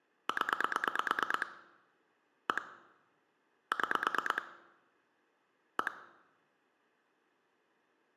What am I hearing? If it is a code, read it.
Pulse dialling, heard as clicks on a phone line, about 9 pulses a second, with room echo. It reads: 0 1 6 1